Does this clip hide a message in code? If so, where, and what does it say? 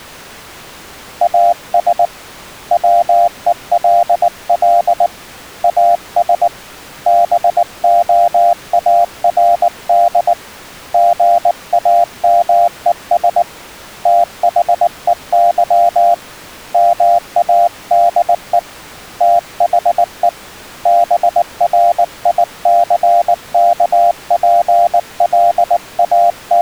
Yes: Morse code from 1.2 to 26.6 s, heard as a keyed tone, hand-sent with a paddle, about 19 wpm, 690 Hz. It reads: AS WELL AS BOARD GAMES THEY MADE THE …